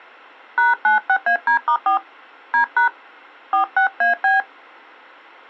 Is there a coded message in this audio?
Yes: DTMF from 0.6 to 4.4 s, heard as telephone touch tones, dialled by hand, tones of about 120 ms. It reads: #96AD*4 D# 46AB